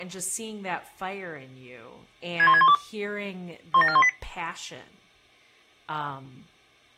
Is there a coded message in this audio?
Yes: five-tone selective call (ZVEI) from 2.4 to 4.1 s, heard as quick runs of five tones, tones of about 70 ms, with speech in English. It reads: 61612 17418